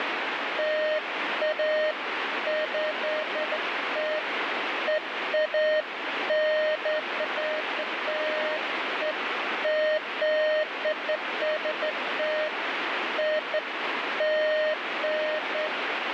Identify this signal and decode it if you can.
Beeps of irregular length, with radio static. There is no code.